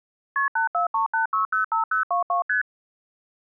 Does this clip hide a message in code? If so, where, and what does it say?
Yes: multi-frequency trunk signalling (R1, as on North American trunks) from 0.4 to 2.6 s, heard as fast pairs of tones, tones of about 120 ms. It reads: KP 8438605022 ST